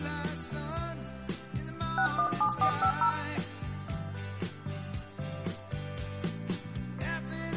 DTMF, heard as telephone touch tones, dialled by hand, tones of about 90 ms, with room echo. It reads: 617450